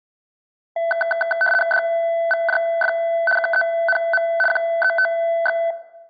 RTTY (75 baud, 850 Hz shift), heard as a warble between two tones, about 1090 Hz centre. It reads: DVJF KENM QETX